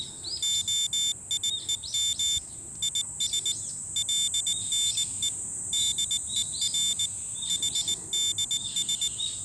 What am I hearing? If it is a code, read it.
Morse code (Hebrew alphabet), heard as a high beeper, machine-sent, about 19 wpm, 3550 Hz, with the noise of a park. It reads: היום יש לנו דור חדש